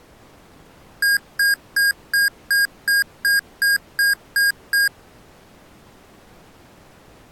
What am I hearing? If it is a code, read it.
Beep code, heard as beeps from a small speaker, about 1600 Hz. 11 short. In AMI BIOS tables: cache memory error.